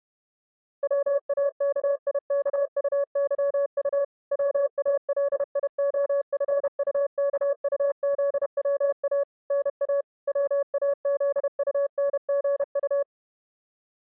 Morse code, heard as a keyed tone, machine-sent, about 31 wpm, 560 Hz. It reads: WAKIKUYU WALIOFUKUZWA NA WAZUNGU